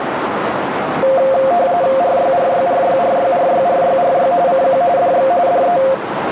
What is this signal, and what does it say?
RTTY (45.45 baud, 170 Hz shift), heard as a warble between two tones, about 620 Hz centre, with radio static and a narrow filter. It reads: RYRYRYRYRYRYRY CQ DX DE